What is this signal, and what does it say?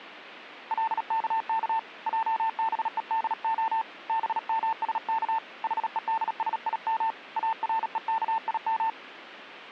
Morse code (Hebrew alphabet), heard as a keyed tone, hand-sent with a paddle, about 37 wpm, 900 Hz. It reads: לכך עבודה במשך חודשים ארוכים